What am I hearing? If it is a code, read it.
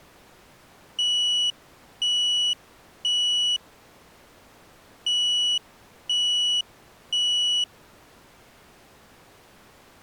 Alarm pattern, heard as an alarm's beeps, played twice, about 2950 Hz. Temporal three. Smoke or fire, evacuate.